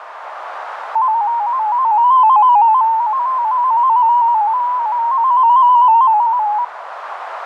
Multi-tone FSK (Olivia or MFSK type), about 250 Hz wide, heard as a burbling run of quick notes, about 15.625 baud, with radio static and a narrow filter.